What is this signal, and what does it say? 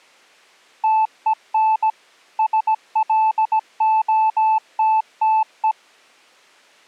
Morse code, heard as a keyed tone, machine-sent, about 17 wpm, 880 Hz. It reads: TEN SLOTTE